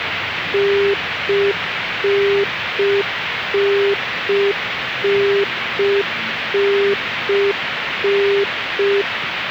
Telephone call progress tone (UK plan), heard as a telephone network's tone, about 400 Hz, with phone line noise and the noise of a park. Congestion tone.